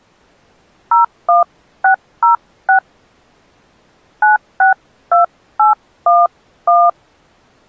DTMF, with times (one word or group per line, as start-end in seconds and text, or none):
0.9-2.8 01606
4.2-6.9 962811